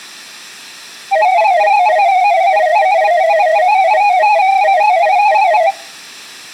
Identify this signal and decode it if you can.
Multi-tone FSK (Olivia or MFSK type), about 250 Hz wide, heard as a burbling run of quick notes, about 31.25 baud.